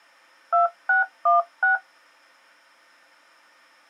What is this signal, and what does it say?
DTMF, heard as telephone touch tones, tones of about 130 ms. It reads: 2616